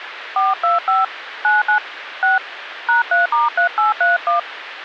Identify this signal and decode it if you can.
DTMF, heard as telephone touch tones, dialled by hand, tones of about 140 ms, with phone line noise. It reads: 425 99 6 #3*3831